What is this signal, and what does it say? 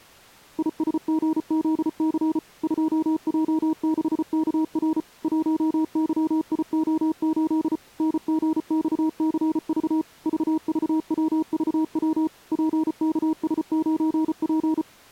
Morse code, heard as a keyed tone, machine-sent, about 34 wpm, 320 Hz. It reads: ISGZC 2J6KR 1YIO8 NGXCV VVWVW PKS9P